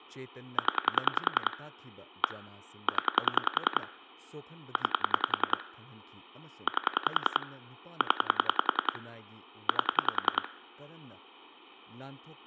Pulse dialling, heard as clicks on a phone line, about 10 pulses a second, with speech in Manipuri. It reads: 0 1 0 9 8 0 8